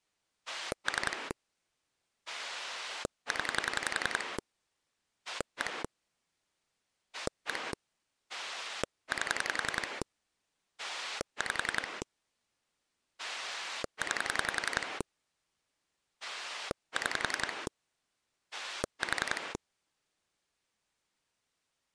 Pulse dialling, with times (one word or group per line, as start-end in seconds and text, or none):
0.5-1.3 3
2.3-4.4 0
5.3-5.8 1
7.1-7.7 1
8.3-10.0 8
10.8-12.0 5
13.2-15.0 9
16.2-17.7 6
18.5-19.5 4